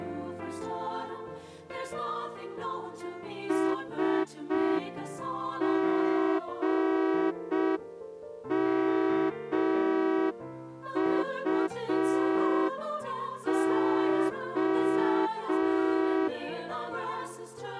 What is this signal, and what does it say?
Morse code, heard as a horn, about 5 wpm. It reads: SGMUO